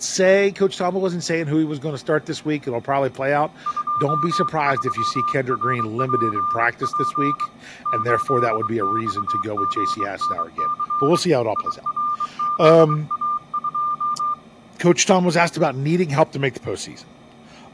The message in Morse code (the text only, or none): 23RPP 8XGNC IRZA2